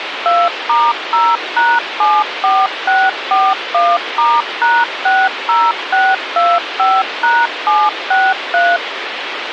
DTMF, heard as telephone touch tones, dialled by machine, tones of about 220 ms, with phone line noise. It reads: 2*0#74641*#60625#763